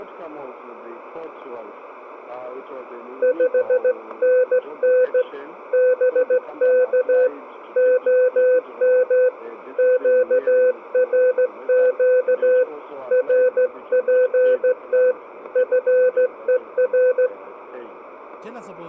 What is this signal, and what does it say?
Morse code, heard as a keyed tone, hand-sent with a straight key, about 15 wpm, 510 Hz, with radio static. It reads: 5NN BK OM QRQ RPT FER